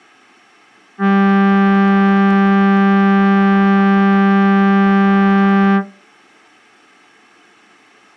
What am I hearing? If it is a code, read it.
Ship horn signal, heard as a ship's horn, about 200 Hz. 1 long. At sea: a vessel nearing a blind bend, or under power and making way in fog.